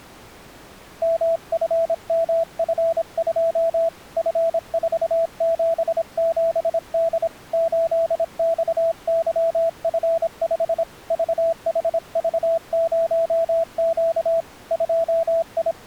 Morse code, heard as a keyed tone, hand-sent with a paddle, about 26 wpm, 660 Hz. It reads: MFMF2 F477D 8XYF5 VHV0Q …